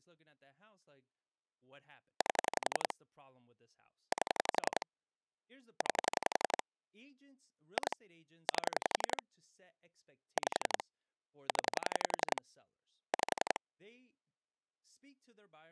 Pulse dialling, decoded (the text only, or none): 8 8 9 2 8 5 0 5